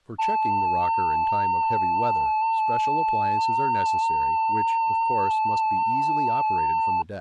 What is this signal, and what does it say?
FT8 (one signal), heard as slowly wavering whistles, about 6.25 baud, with speech in English.